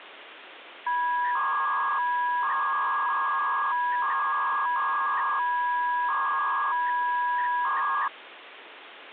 300-baud modem data (V.21 tones), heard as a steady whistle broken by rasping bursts, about 300 baud, 200 Hz shift, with phone line noise.